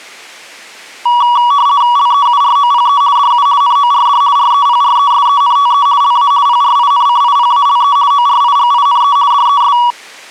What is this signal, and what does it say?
RTTY (50 baud, 170 Hz shift), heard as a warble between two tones, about 1050 Hz centre. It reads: LEUROPE DU NORD REPRESENTE LA PRINCIPALE ORIGINE DES